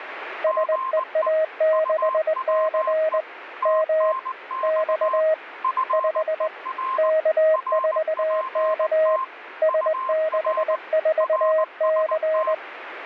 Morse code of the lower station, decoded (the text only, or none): SEA6C M X 5 K4K S64C